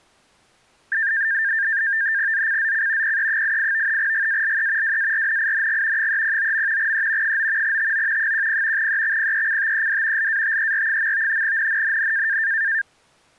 NAVTEX (SITOR-B), 100 baud, 170 Hz shift, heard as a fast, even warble, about 1700 Hz centre. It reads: ZCZC PE88 GALE WARNING 309. E 9 TO 10 EXPECTED LATER. NNNN